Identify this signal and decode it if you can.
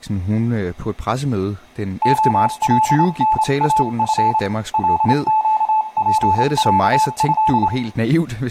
Morse code (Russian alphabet), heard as a keyed tone, hand-sent with a straight key, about 27 wpm, 870 Hz, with room echo and speech in Danish. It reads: ОЛНАФ ЛЩПЯЭ